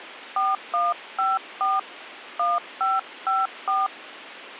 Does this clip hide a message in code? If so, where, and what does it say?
Yes: DTMF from 0.4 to 3.9 s, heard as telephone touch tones, dialled by hand, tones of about 190 ms, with phone line noise. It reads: 4154 1554